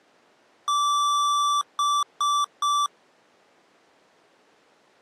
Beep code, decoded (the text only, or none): 1 long, 3 short